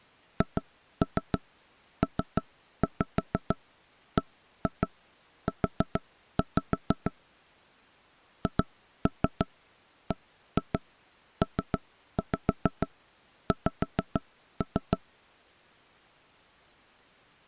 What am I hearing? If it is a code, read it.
Tap code, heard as knocks on wood, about 6 knocks a second. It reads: HPBU HBPX